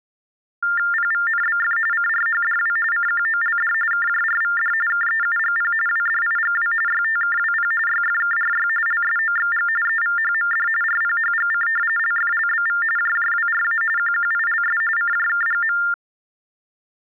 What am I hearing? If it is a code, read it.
TTY/TDD text telephone tones (45.45 baud Baudot), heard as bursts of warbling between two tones, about 400 Hz shift, 1600 Hz centre. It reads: PVNBF CRHDW CQOLD KJRVD KEUGP WDIGW YTKWP YFKRY LSOXG EVHMD RPHGC LFLBV JJWRA QQILS CJKGM